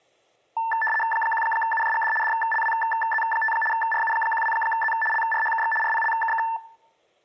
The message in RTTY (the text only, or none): 1UJGD DLWZ5 RU12Z LRHKX RPLKK